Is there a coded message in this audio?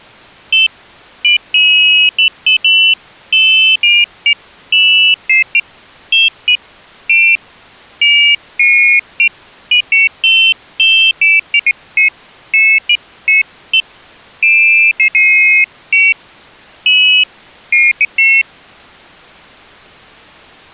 No, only pairs of high tones at irregular times.